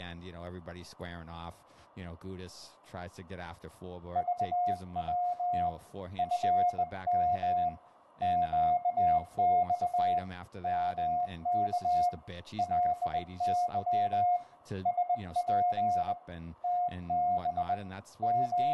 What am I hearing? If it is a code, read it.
Morse code, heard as a keyed tone, hand-sent with a bug key, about 20 wpm, 710 Hz, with room echo and speech in English. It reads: VW FM QX MK LY SP TB …